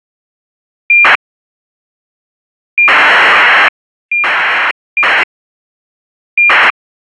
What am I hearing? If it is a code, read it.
ACARS aircraft data, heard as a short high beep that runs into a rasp, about 2400 baud.